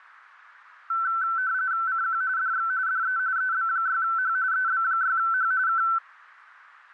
RTTY (45.45 baud, 170 Hz shift), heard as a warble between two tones, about 1430 Hz centre, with radio static. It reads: CQ DX DE EB6H EB6H K